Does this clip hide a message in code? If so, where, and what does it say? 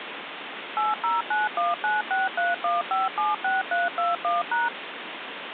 Yes: DTMF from 0.8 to 4.7 s, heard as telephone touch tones, dialled by machine, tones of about 170 ms, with phone line noise. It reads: 80919631576321#